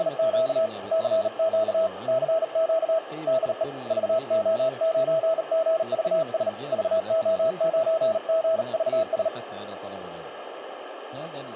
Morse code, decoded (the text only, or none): … CQ CQ DE VO9GVS VO9GVS